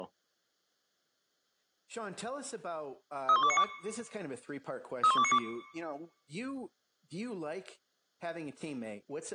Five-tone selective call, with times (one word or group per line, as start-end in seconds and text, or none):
3.3-3.6 31292
5.0-5.4 31292